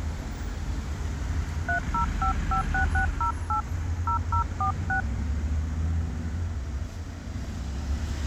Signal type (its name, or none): DTMF